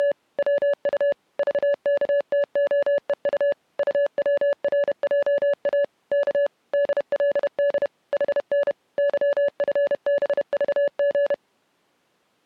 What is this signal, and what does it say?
Morse code, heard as a keyed tone, machine-sent, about 31 wpm, 570 Hz. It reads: … WU VKTOEU UWRJA K DLD HN YFBVG